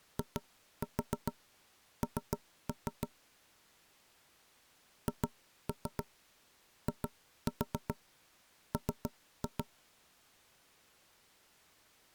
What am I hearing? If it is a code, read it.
Tap code, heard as knocks on wood, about 7 knocks a second. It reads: IN HIM